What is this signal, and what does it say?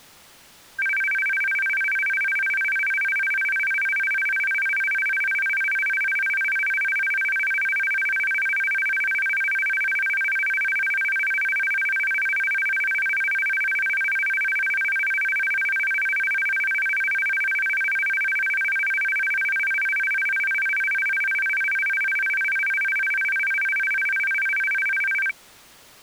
A tone that alternates evenly between two pitches. There is no code.